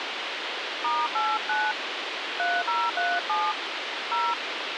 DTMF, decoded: *89 3037 0

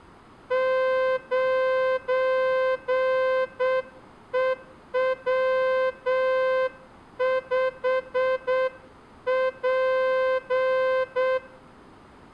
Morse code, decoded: 9EW5P

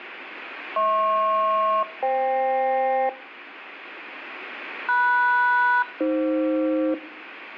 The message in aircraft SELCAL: HP-FK MS-AF

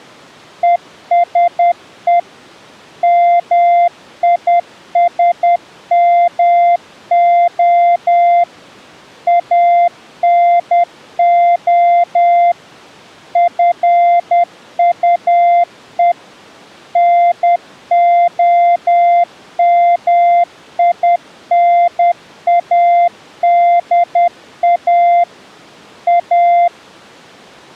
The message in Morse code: ESE MISMO ANO FUE NOMINADA A

